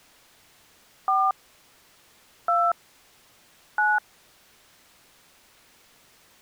DTMF, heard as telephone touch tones, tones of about 190 ms. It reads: 4 2 9